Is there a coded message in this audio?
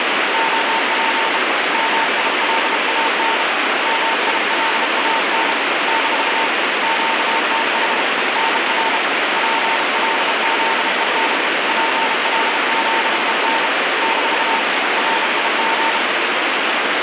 Yes: Morse code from 0.3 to 16.0 s, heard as a keyed tone, hand-sent with a bug key, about 32 wpm, 900 Hz, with heavy radio static. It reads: OP MILAN MILAN - QTH NR PLZEN PLZEN - RIG